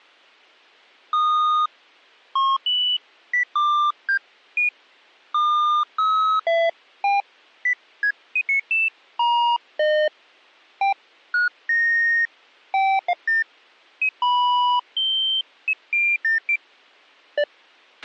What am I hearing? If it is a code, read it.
Electronic bleeps of random pitch and length, with a squelch burst at the end. There is no code.